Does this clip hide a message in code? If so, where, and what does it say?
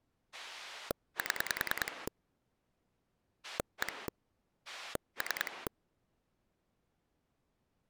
Yes: pulse dialling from 0.3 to 5.7 s, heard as a rotary dial, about 10 pulses a second. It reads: 7 1 3